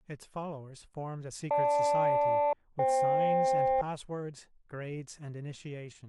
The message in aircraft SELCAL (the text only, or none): GL-FK